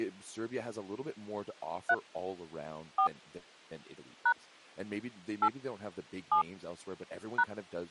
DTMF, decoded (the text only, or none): 3 4 # 8 7 #